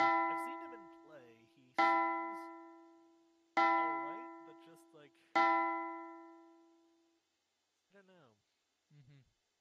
Clock strike, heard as a bell, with room echo and speech in English. 4. Four o'clock.